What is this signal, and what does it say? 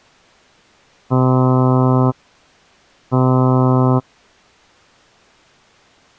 Ship horn signal, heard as a ship's horn, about 130 Hz. 2 short. At sea: I am altering course to port.